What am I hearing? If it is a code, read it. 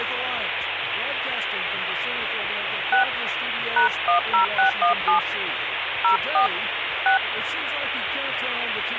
DTMF, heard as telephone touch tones, dialled by hand, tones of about 110 ms, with phone line noise. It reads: 6 #10617 04 6